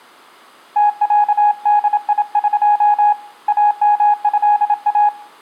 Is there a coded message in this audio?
Yes: Morse code (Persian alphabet) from 0.7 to 5.1 s, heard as a keyed tone, hand-sent with a paddle, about 27 wpm, 830 Hz, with room echo. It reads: تصدیق امضا